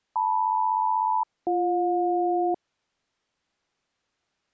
Aircraft SELCAL, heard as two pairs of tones. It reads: LM-BJ